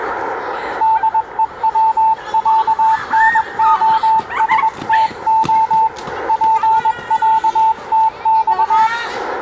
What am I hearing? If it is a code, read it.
Morse code (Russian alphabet), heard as a keyed tone, hand-sent with a paddle, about 21 wpm, 890 Hz, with radio static and the noise of a park. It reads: ДЕВЯНОСТО ПЯТЬ